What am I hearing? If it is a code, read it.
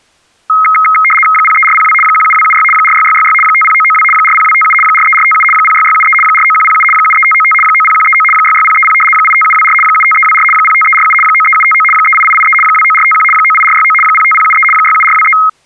RTTY (75 baud, 850 Hz shift), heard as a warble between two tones, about 1700 Hz centre. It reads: 03402 17276 46666 50992 40257 43457 06673 49107 73595 90139 66030 85724 75324 05347 93759 38883 29451 98469 05073 67423